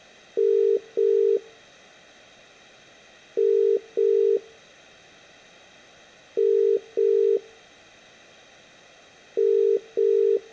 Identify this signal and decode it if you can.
Telephone call progress tone (as in the UK, Ireland, Australia and similar networks), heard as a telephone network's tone, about 400, 450 Hz, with room echo. Ringback tone.